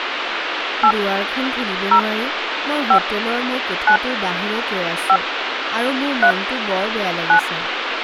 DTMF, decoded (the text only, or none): 8 0 5 9 5 3 9